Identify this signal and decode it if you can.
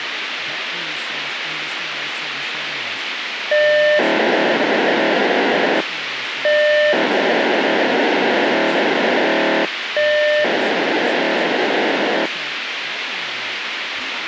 POCSAG pager data (1200 baud), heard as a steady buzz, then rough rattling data, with radio hiss and speech in English.